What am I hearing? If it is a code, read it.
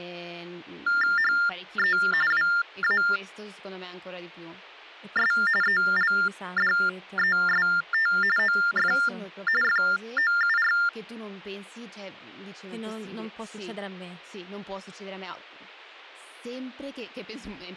TTY/TDD text telephone tones (45.45 baud Baudot), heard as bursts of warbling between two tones, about 400 Hz shift, 1600 Hz centre, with speech in Italian. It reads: HE WAS ELDEST OF FOUR